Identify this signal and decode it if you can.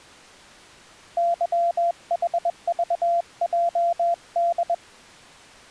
Morse code, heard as a keyed tone, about 21 wpm, 690 Hz. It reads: YHVJD